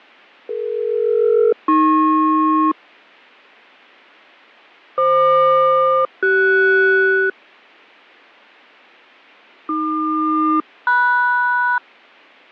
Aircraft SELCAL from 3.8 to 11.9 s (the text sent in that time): FQ-CS AQ-MS